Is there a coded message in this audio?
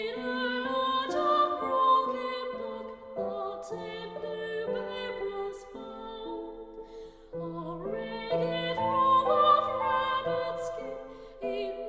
No.